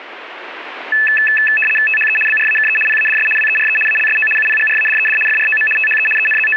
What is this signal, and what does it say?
RTTY (75 baud, 850 Hz shift), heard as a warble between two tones, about 2150 Hz centre. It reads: THE BRAKE PADS WERE ALSO UPGRADED FROM THE …